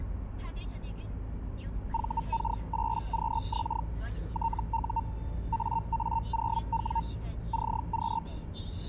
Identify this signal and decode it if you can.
Hellschreiber (Feld-Hell, 122.5 baud), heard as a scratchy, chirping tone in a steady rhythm, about 910 Hz, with the noise inside a car. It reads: VK8QX TU AA0W CQ